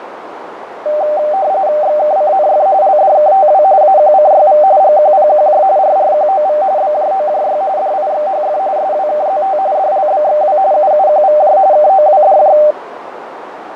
RTTY (45.45 baud, 170 Hz shift), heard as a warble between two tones, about 690 Hz centre, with radio static and a narrow filter. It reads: XKCNF LDKTW AQCYV GQPQJ RRQOV BJOJY DIXHF SWKZT DLBXW UUQVJ KOWDJ